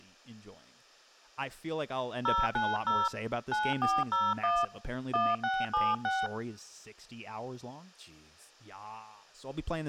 DTMF, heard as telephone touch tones, dialled by hand, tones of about 220 ms, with speech in English. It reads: 090 9401 1676